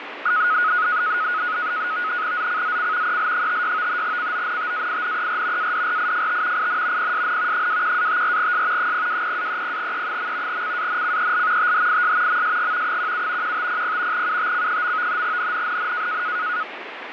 NAVTEX (SITOR-B), 100 baud, 170 Hz shift, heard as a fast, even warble, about 1360 Hz centre, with radio static. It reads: ZCZC EL56 CONTAINER ADRIFT IN PSN 21-54S 020-30E. CANCEL THIS MSG 17 1500 UTC. NNNN